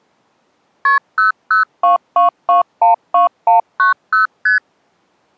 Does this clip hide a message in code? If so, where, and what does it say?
Yes: multi-frequency trunk signalling (R1, as on North American trunks) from 0.9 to 4.6 s, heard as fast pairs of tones, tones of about 130 ms. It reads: KP 0022212190 ST